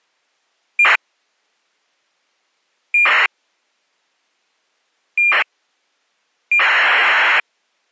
ACARS aircraft data, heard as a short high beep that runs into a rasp, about 2400 baud.